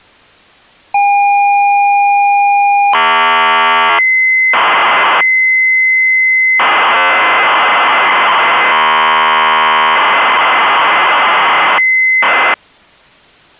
ZX Spectrum tape loading, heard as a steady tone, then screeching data.